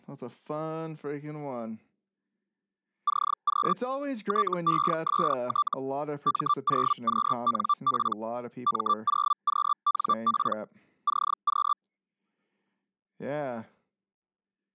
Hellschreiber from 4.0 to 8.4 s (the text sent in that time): TEST M0QNP